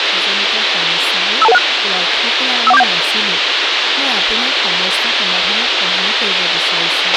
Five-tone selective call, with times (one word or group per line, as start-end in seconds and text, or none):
1.4-1.6 52216
2.7-2.8 51471